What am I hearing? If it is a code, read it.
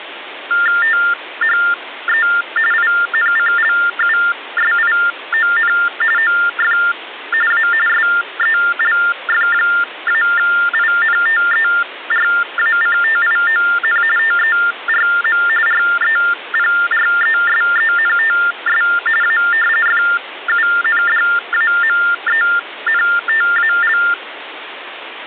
TTY/TDD text telephone tones (45.45 baud Baudot), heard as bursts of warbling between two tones, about 400 Hz shift, 1600 Hz centre, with phone line noise. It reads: THE INCLUSION OF A SELF-INTERACTION TERM REPRESENTS A FUNDAMENTAL